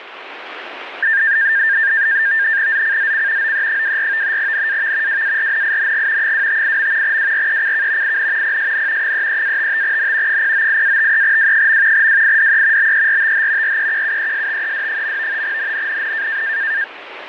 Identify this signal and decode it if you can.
NAVTEX (SITOR-B), 100 baud, 170 Hz shift, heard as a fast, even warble, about 1700 Hz centre, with radio static. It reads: ZCZC OE24 NAV WARNING 258. WRECK IN PSN 33-55N 098-53W. WIDE BERTH REQUESTED. NNNN